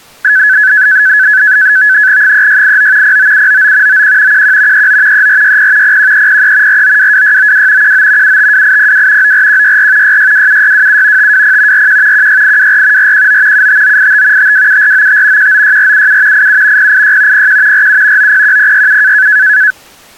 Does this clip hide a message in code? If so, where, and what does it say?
Yes: NAVTEX (SITOR-B), 100 baud, 170 Hz shift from 0.2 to 19.7 s, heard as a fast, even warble, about 1600 Hz centre. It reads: 3689 09799 91 11 39 3460 01303 4922692 19 752802 94164 6627627 520 41 16824 419 75985 527495 196477 87 086 01 47 901067